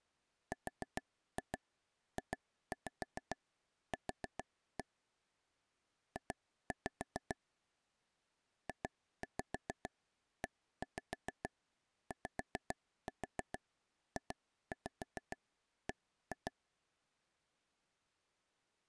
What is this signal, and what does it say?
Tap code, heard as taps on a table, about 7 knocks a second. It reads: RJQ J JEYJB